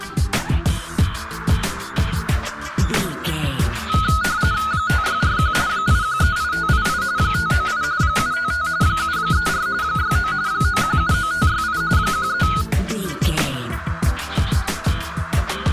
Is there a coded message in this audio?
Yes: RTTY (45.45 baud, 170 Hz shift) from 3.9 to 12.6 s, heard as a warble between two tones, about 1360 Hz centre. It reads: 5641 8138588 598 755 734 69 9179568 13